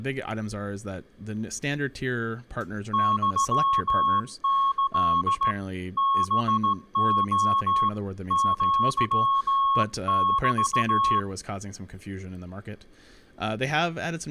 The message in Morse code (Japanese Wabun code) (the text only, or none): ユキ ハレ アメ